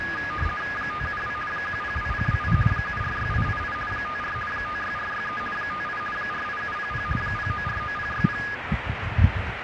RTTY (50 baud, 450 Hz shift), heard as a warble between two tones, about 1450 Hz centre, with radio static and the noise of a park. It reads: 572 102028 746888 54 56463 58 48700 0949060